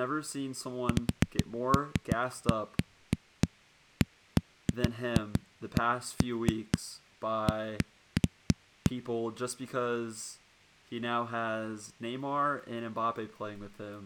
Irregular knocks on a wall, with speech in English. There is no code.